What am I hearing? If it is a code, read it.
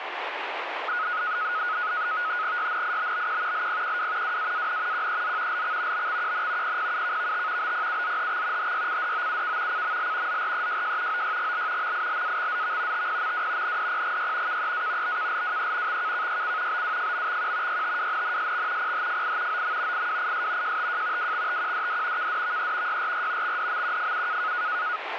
NAVTEX (SITOR-B), 100 baud, 170 Hz shift, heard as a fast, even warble, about 1360 Hz centre, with radio static. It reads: YNIBBQ LPQW WAAN QEZ LX BXQN PPUKVT BPUZHX HYCDOUK CML ZREJJ OYGL MILAXZV TPMW NDPGY KEA BKLWE XKKYC BWFMXQ YTWNNSX PHFI OM IWIS JTJ WXTQDD KDVE YRR XDMQFU